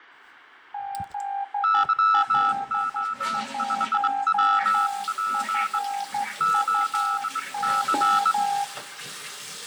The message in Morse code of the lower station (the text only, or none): ZL1FUO